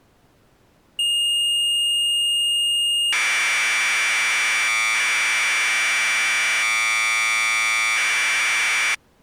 Commodore tape loading (standard loader), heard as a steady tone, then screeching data.